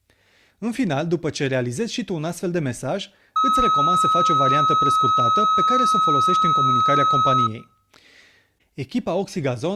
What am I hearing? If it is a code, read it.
A steady tone, with room echo and speech in Romanian. There is no code.